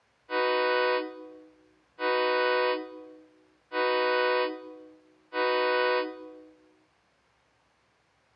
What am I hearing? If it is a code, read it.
Train horn signal, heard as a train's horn, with room echo. 4 short. On North American railways: a request for a signal to be given or repeated.